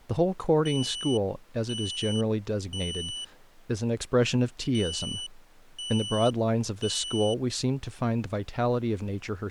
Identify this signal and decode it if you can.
Alarm pattern, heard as an alarm's beeps, played twice, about 2950 Hz, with speech in English. Temporal three. Smoke or fire, evacuate.